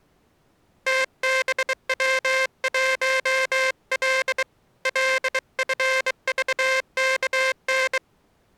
Morse code, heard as a buzzer, hand-sent with a bug key, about 23 wpm. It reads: TBW1L LFVKN